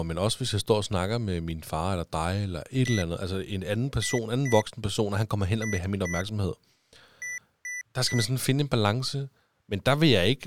Beep code, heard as beeps from a small speaker, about 2000 Hz, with speech in Danish. 1-2-2-3. In Phoenix BIOS tables: BIOS ROM checksum failure.